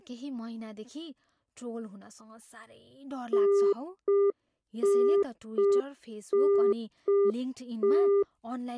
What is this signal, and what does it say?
Telephone call progress tone (UK plan), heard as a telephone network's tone, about 400 Hz, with speech in Nepali. Congestion tone.